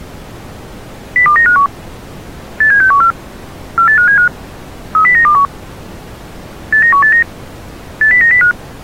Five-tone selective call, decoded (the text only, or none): 02951 87614 48575 30921 89189 80905